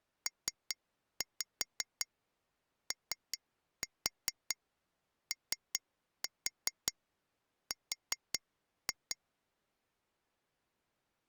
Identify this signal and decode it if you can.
Tap code, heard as taps on glass, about 5 knocks a second. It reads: POOR